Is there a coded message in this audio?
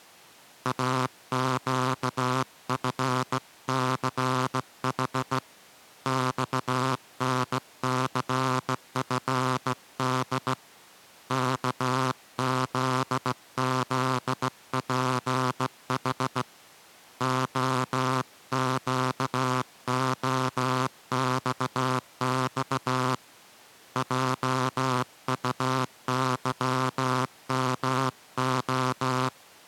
Yes: Morse code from 0.6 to 29.3 s, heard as a buzzer, hand-sent with a straight key, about 16 wpm. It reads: AQFCH XNCFD KZZPH OQOXX JUYMO